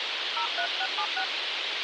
DTMF, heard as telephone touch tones, dialled by hand, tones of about 70 ms, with radio hiss. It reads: 03676